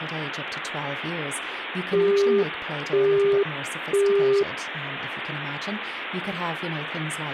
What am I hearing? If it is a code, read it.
Telephone call progress tone (single-tone plan, as in Europe, Japan and elsewhere), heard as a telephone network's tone, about 400 Hz, 0.5 s on and 0.5 s off, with phone line noise and speech in English. Busy tone.